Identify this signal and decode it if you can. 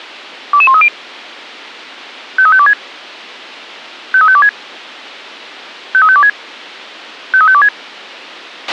Five-tone selective call (ZVEI), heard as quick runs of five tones, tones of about 70 ms, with a squelch burst at the end. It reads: 22130 53526 53526 53526 53526